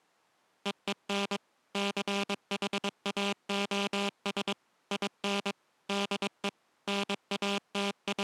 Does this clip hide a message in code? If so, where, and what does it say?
Yes: Morse code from 0.6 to 8.2 s, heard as a buzzer, machine-sent, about 22 wpm. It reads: EEN CHAOS IN DE …